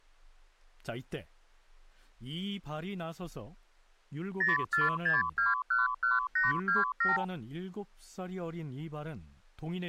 Multi-frequency trunk signalling (R2, with the far end's replies), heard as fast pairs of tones, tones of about 160 ms, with speech in Korean. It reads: 046211827